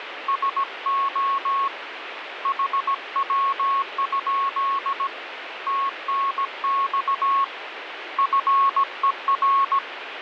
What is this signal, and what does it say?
Morse code, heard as a keyed tone, hand-sent with a paddle, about 17 wpm, 1100 Hz, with radio static. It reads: SO HW? TNX FER